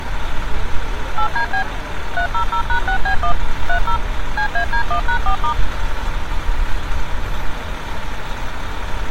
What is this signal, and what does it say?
DTMF, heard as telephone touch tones, dialled by machine, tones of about 90 ms, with street noise. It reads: 8DB 300#6B1 30 CAD1#4*